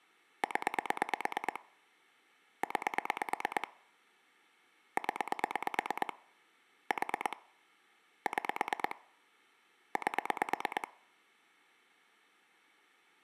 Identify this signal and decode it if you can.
Pulse dialling, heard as clicks on a phone line, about 9 pulses a second. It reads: 0 9 0 4 6 8